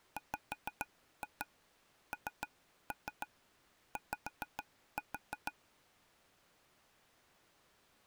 Tap code, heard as taps on a table, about 6 knocks a second. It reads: WNY